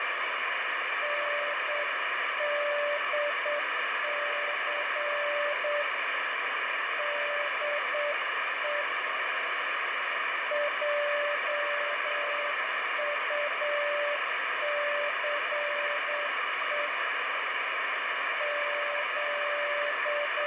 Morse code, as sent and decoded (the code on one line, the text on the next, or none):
-. -.. -.-. / -.. . / .--- ..- -.-. . / …
NDC DE JUCE …